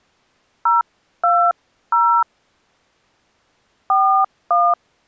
DTMF, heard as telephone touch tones, dialled by hand, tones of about 250 ms. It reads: 020 41